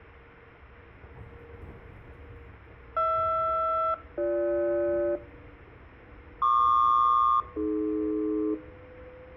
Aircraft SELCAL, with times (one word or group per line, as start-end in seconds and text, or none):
3.0-5.2 HR-BG
6.4-8.5 PQ-AD